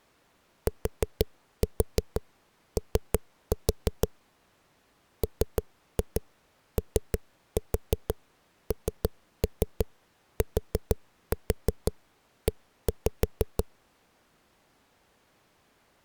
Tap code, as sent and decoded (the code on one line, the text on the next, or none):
4-4 3-4 / 3-2 3-4 3-3 4-4 1-5
TO MONTE